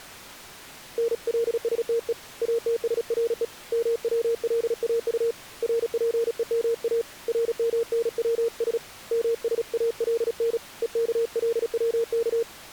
Morse code, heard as a keyed tone, hand-sent with a paddle, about 36 wpm, 460 Hz. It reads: NLSTE ATSRE MWLAU RPEMA RMNWS MSALN EKLWK